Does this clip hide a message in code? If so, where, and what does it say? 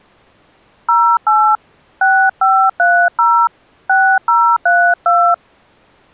Yes: DTMF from 0.9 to 5.3 s, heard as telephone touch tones, dialled by hand, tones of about 290 ms. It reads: 08 6530 6032